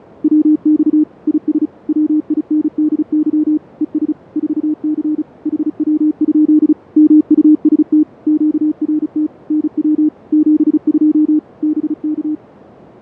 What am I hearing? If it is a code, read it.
Morse code, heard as a keyed tone, machine-sent, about 35 wpm, 300 Hz, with fading. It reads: WX IS WINDY ES 4C HW? MUST QRT NW 72 BK